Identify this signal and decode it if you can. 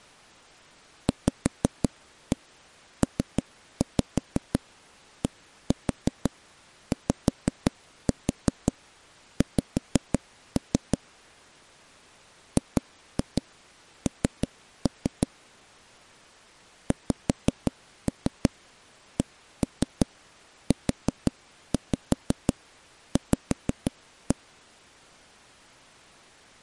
Tap code, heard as knocks on wood, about 5 knocks a second. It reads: VPDYX GN XCUV